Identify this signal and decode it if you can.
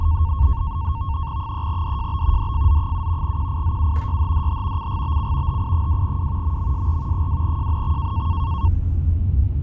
NAVTEX (SITOR-B), 100 baud, 170 Hz shift, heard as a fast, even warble, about 1000 Hz centre, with the noise inside a car. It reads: 3DJB DFZ7 QIZU YHDH CGBC HI2W MMSR 2JNX